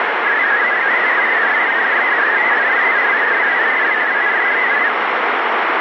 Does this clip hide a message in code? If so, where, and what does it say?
Yes: multi-tone FSK (Olivia or MFSK type), about 500 Hz wide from 0.3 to 4.9 s, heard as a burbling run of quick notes, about 62.5 baud, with heavy radio static.